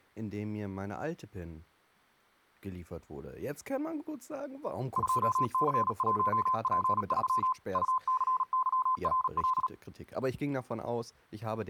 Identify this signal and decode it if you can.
Morse code, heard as a keyed tone, machine-sent, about 37 wpm, 1030 Hz, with speech in German. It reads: 2C1P3 UCYRL